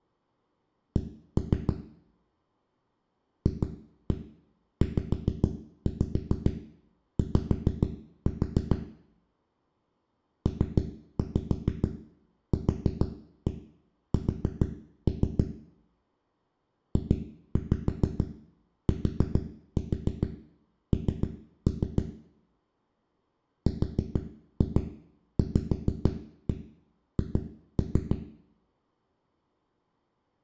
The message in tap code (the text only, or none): C FZY PQS JTN RVH